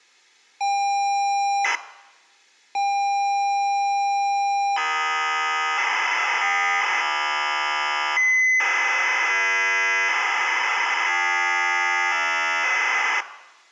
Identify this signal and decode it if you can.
ZX Spectrum tape loading, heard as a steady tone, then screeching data, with room echo.